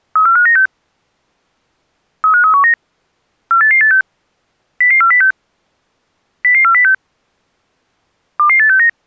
Five-tone selective call (CCIR), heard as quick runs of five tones, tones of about 100 ms. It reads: 34596 35319 48886 00406 00406 22869